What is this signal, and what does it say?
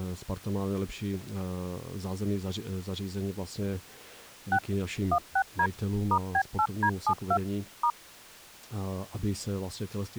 DTMF, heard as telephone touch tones, dialled by machine, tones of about 70 ms, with speech in Czech. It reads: 6 16D *B8D72 *